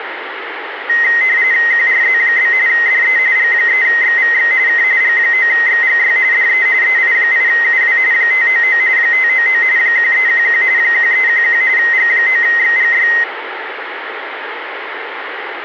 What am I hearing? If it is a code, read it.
RTTY (45.45 baud, 170 Hz shift), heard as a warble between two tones, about 1950 Hz centre, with radio static. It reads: QRZ? DE G3XVX K G9XGY DE EI8UW 599 599 1311 1311 G9XGY